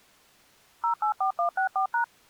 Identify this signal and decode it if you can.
DTMF, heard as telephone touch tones, dialled by machine, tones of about 100 ms. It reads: 084164#